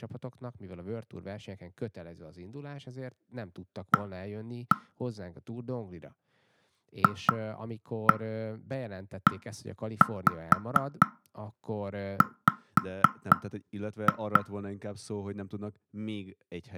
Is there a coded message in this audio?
Yes: tap code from 3.9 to 14.4 s, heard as knocks on wood, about 4 knocks a second, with speech in Hungarian. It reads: A FEW